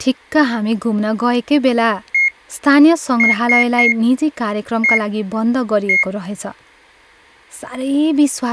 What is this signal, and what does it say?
Beep code, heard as a piezo beeper, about 2150 Hz, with speech in Nepali. 1-3-1-1. In Phoenix BIOS tables: memory refresh test failure.